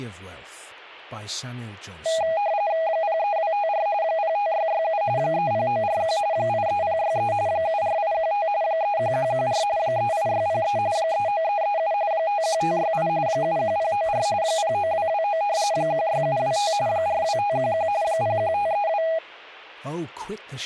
RTTY (45.45 baud, 170 Hz shift), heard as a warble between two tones, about 730 Hz centre, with speech in English. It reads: 03254 05667 30941 83063 74815 31114 38603 39337 51568 71094 09229 16725 42511 01532